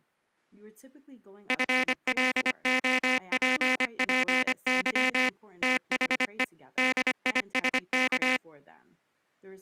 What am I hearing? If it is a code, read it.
Morse code, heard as a buzzer, machine-sent, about 25 wpm, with speech in English. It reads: FLOPPY THE DISK